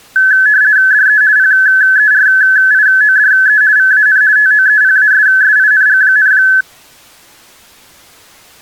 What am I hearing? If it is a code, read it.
RTTY (50 baud, 170 Hz shift), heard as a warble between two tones, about 1600 Hz centre. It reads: DE PERIODE VAN TOEPASSING,